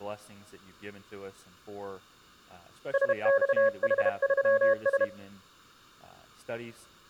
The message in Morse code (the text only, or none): SXH3S